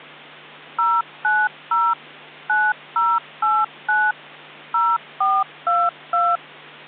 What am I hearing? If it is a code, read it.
DTMF, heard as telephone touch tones, dialled by machine, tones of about 230 ms, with hum. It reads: 090 9089 0422